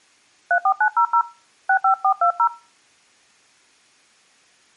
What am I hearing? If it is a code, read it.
DTMF, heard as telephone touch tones, dialled by hand, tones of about 80 ms. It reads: 34900 65420